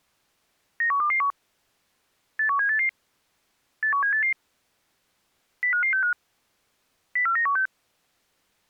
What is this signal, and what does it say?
Five-tone selective call (CCIR), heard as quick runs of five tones, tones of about 100 ms. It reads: 91221 81788 81788 05565 04916